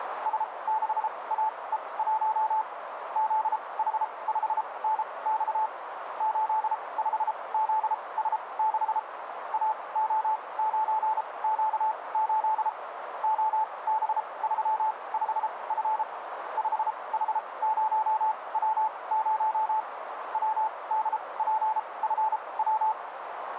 Morse code, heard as a keyed tone, machine-sent, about 33 wpm, spaced as for 23 wpm, 870 Hz, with radio static and a narrow filter. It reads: S6AE1 ZH5NX 85ZS6 AO9Q8 OB35F 5H0W0 WDPFW